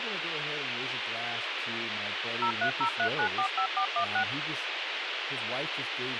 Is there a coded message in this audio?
Yes: DTMF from 2.4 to 4.2 s, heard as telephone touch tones, dialled by machine, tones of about 90 ms, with radio hiss and speech in English. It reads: 0303945416